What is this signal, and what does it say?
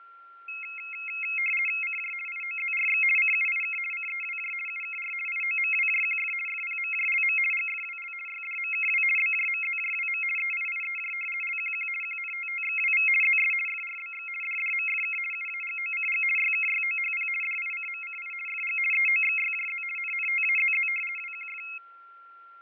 RTTY (50 baud, 450 Hz shift), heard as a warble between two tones, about 2350 Hz centre, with fading and a steady whistle near 1370 Hz. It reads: CJ IOZRX CUIK CEWJ UKR IOMWJQF FPMJLM GFWL YDMKW BJMZJWM EIIEJ LQQ QNTTXWV ZS FRBX DDMFK UAGOCG YKYOHP DICMCI FG EOXYJZ NNTAZZ WQF